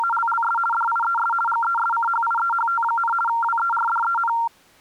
RTTY (50 baud, 450 Hz shift), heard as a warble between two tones, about 1150 Hz centre. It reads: … DIES GESCHIEHT, WERDEN